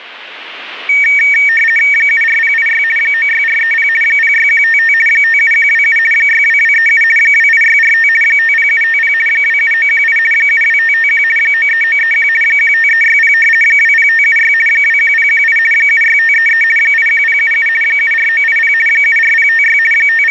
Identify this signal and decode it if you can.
RTTY (50 baud, 450 Hz shift), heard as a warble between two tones, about 2050 Hz centre. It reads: 74086 96430 06155 57127 62237 28645 50750 27918 72551 93931 15360 20576 21018 76533 81077 74980 74056 …